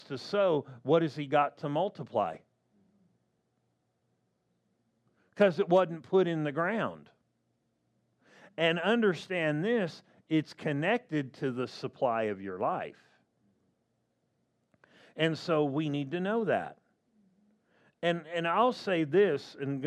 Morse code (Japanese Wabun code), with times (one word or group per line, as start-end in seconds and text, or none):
none